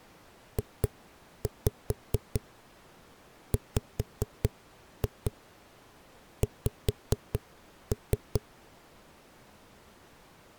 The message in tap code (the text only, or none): JWX